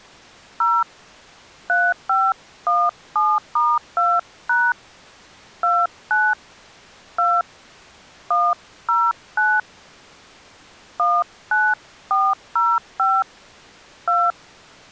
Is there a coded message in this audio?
Yes: DTMF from 0.6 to 14.3 s, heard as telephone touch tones, dialled by hand, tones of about 230 ms. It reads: 0 3517*2# 29 2 109 19405 2